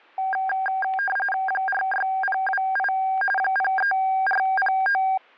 RTTY (45.45 baud, 850 Hz shift), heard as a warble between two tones, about 1190 Hz centre, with static crashes. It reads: 46028 03409